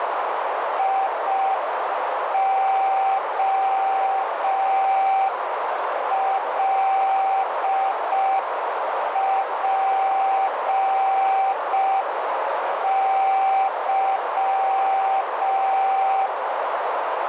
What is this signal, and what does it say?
Morse code, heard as a keyed tone, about 5 wpm, 780 Hz, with heavy radio static and a narrow filter. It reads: IOLPY